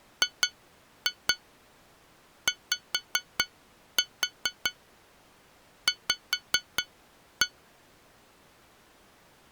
Tap code, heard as taps on glass, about 4 knocks a second. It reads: GYV